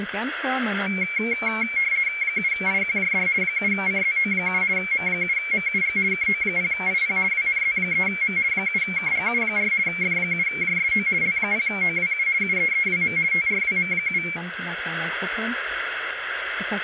RTTY (50 baud, 170 Hz shift), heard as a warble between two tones, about 2250 Hz centre, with radio static. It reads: 7IQJD 7CZO7 M7MUG KO0IP WNZ3M 7KGU4 F7JSO L0OWU UEEWM TRWM7